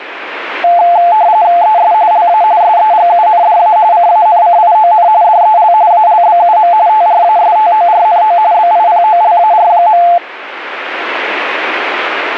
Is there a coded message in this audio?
Yes: RTTY (45.45 baud, 170 Hz shift) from 0.6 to 10.2 s, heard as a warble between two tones, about 780 Hz centre. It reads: ES LA SEGUNDA CANCION DEL ALBUM TRASTORNO BIPOLAR.